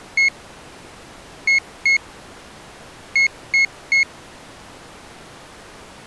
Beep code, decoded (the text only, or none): 1-2-3